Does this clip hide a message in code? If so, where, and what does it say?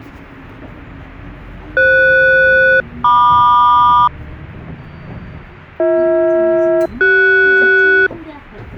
Yes: aircraft SELCAL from 1.8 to 8.1 s, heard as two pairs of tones, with the noise inside a bus. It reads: FS-MQ BH-CS